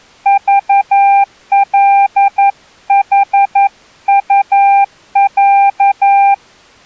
Morse code (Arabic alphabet), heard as a keyed tone, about 11 wpm, 800 Hz. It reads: ضلحطع